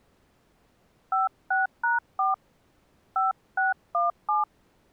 DTMF, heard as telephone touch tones, dialled by hand, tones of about 160 ms. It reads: 56#4 5617